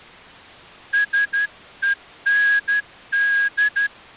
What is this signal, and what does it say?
Morse code, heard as a whistle, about 12 wpm. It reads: SEND